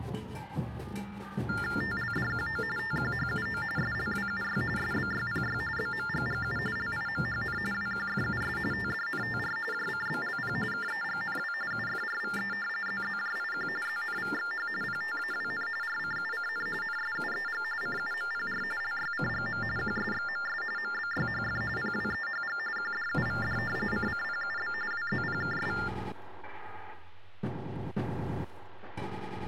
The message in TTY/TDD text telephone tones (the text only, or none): TLDQO TQHUO SLWUY SBYPY BMGGU LIMHN WQFUS TDNTR JCBLP KEGNW UFRVE ZZJIQ ZNVXH PTAWN RCUCN NSUEG CUMPR LYCGM QSXMS MBYHF PWEHG QDUVD CCPUB WZPKS